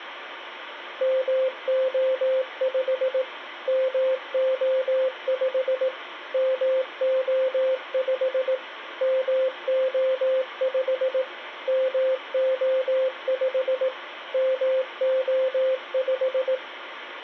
Morse code, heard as a keyed tone, machine-sent, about 18 wpm, 520 Hz, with radio hiss. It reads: MO5 MO5 MO5 MO5 MO5 MO5